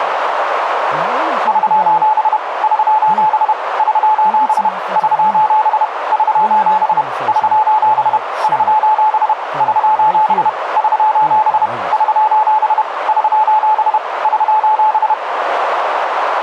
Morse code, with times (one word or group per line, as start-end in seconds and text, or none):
1.5-2.4 <SOS>
2.6-3.5 <SOS>
3.8-4.7 <SOS>
5.0-5.8 <SOS>
6.1-7.0 <SOS>
7.3-8.2 <SOS>
8.4-9.3 <SOS>
9.6-10.5 <SOS>
10.8-11.7 <SOS>
11.9-12.8 <SOS>
13.1-14.0 <SOS>
14.2-15.1 <SOS>